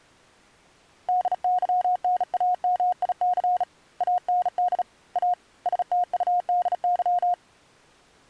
Morse code, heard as a keyed tone, hand-sent with a bug key, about 36 wpm, 720 Hz. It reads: DYNAMIC AND A STUDY